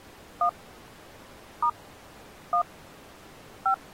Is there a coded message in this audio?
Yes: DTMF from 0.4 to 3.7 s, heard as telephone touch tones, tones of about 80 ms. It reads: 1 * 1 5